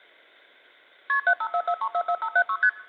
Multi-frequency trunk signalling (R1, as on North American trunks), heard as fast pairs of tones, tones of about 70 ms. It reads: KP 7544344576 ST